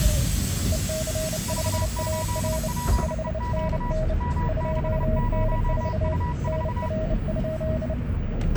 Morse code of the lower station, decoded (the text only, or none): EC5AR 5NN 2N4 NR?